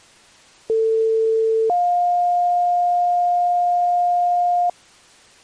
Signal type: two-tone page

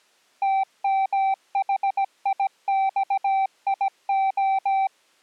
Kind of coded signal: Morse code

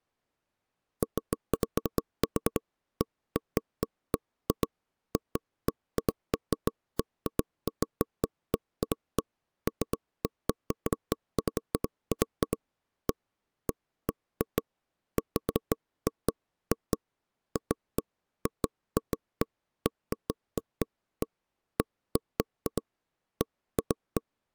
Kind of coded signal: none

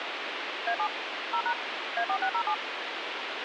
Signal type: DTMF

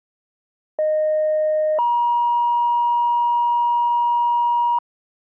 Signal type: two-tone page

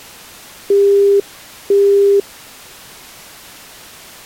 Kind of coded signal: telephone call progress tone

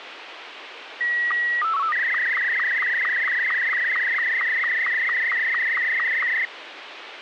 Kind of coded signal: SSTV (slow-scan television)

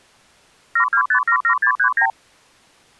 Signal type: multi-frequency trunk signalling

